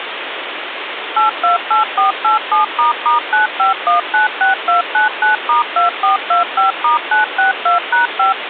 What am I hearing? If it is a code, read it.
DTMF, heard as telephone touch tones, dialled by machine, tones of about 130 ms, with phone line noise. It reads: 828487**95196299*2425*962#5